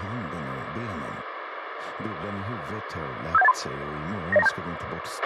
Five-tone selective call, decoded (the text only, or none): 57183 90927